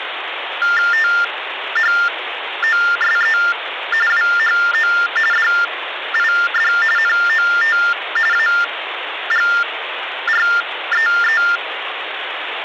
TTY/TDD text telephone tones (45.45 baud Baudot), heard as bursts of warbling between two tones, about 400 Hz shift, 1600 Hz centre, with phone line noise. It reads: THOSE WHO DID NOT AGREE